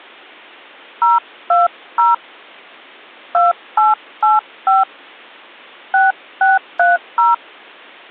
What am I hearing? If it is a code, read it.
DTMF, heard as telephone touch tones, dialled by hand, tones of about 170 ms. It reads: 020 2885 6630